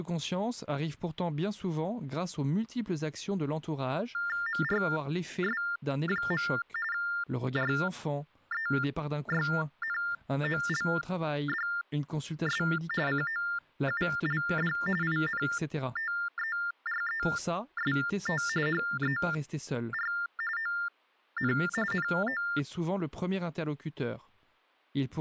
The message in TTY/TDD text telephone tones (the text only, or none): MRS. REYNOLDS COULD INTEREST HER ON NO